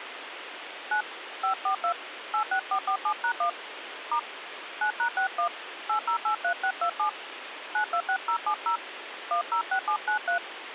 DTMF, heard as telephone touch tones, dialled by hand, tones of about 90 ms, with phone line noise. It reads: 9 542 86447#1 * 9#61 8083627 926070 106793